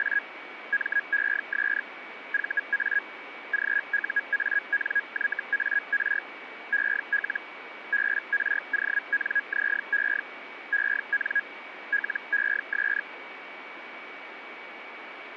Hellschreiber (Feld-Hell, 122.5 baud), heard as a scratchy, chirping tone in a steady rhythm, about 1650 Hz, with radio static and a steady whistle near 2270 Hz. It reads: … MES VA GUANYAR EL BRONZE EN LES